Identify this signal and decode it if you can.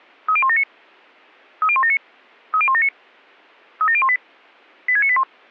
Five-tone selective call (ZVEI), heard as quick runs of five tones, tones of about 70 ms. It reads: 30179 30179 30179 37018 86981